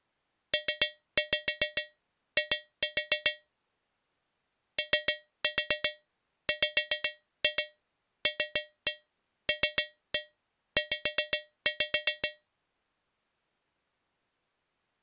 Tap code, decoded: PI OWLLZ

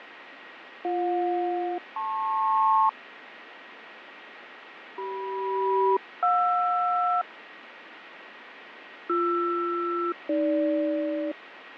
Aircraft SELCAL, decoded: BJ-LP CM-JR BR-AG

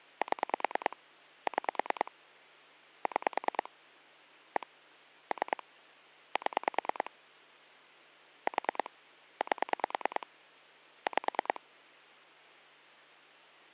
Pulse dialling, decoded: 7 6 6 1 3 7 4 8 5

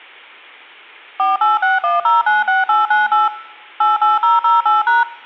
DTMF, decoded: 4861096898 88008#

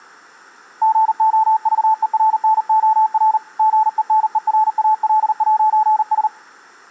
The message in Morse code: GOVERNOR GENERAL'S

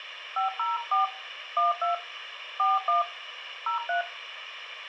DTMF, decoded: 504 12 41 03

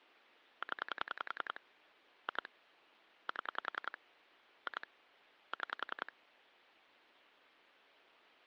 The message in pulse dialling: 0 2 7 2 6

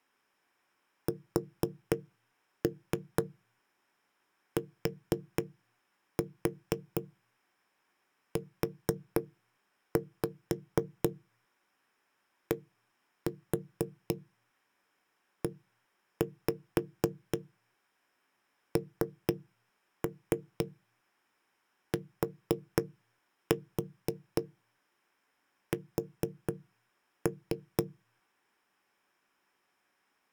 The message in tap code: STUDENTS

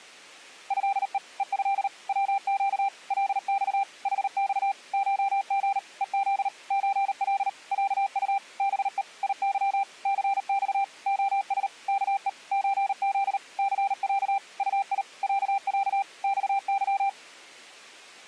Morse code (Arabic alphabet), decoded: هء ءه وق لص حص شغ ءذ زل عط بء يظ ثص خس كء زذ ثع طي عع صظ

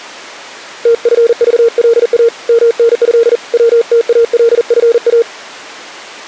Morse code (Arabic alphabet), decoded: تفضلا منه وتالفا

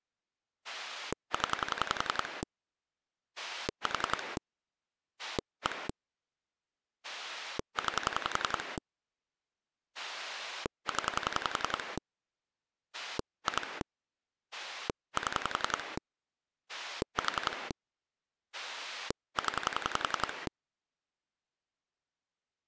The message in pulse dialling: 0 4 1 9 0 2 7 4 0

